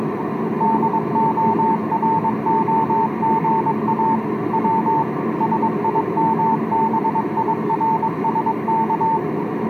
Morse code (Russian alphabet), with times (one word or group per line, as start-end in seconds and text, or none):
0.6-4.2 ДОРОГА
4.5-5.0 В
5.4-9.2 СИМБИРСК